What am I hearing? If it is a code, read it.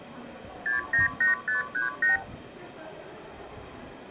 Multi-frequency trunk signalling (R2, with the far end's replies), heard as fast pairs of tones, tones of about 140 ms, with the noise of a crowd indoors. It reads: 698538